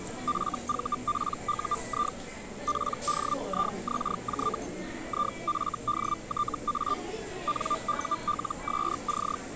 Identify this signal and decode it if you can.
Hellschreiber (Feld-Hell, 122.5 baud), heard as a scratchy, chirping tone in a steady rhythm, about 1190 Hz, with the noise of a restaurant. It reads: FVPUI PDIXJ IFDTA NULSC